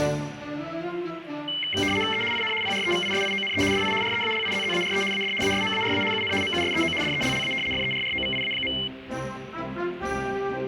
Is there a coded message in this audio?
Yes: RTTY (75 baud, 850 Hz shift) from 1.5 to 8.9 s, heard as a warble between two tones, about 2550 Hz centre, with radio static. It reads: E IN PREVISIONE DI REALIZZARE AD ASMARA UN MUSEO DELLA FERROVIA.